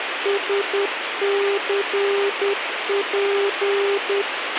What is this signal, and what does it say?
Morse code, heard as a keyed tone, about 10 wpm, 400 Hz, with radio hiss and a squelch burst at the end. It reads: SCP